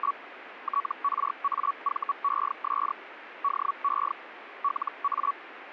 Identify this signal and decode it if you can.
Hellschreiber (Feld-Hell, 122.5 baud), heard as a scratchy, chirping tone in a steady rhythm, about 1130 Hz, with radio static. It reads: … TRAVES DE LA